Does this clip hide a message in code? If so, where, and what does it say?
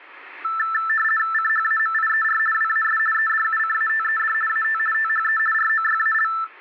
Yes: RTTY (50 baud, 450 Hz shift) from 0.4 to 6.4 s, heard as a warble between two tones, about 1550 Hz centre. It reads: CHAMIER WAS EDUCATED AT THE ROYAL